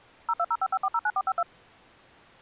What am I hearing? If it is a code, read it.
DTMF, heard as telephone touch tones, dialled by machine, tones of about 50 ms. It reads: 02055409452